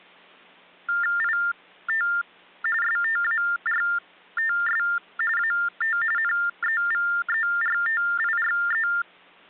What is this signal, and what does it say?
TTY/TDD text telephone tones (45.45 baud Baudot), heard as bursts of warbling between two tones, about 400 Hz shift, 1600 Hz centre. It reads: IT STARTS AT NEVERTIRE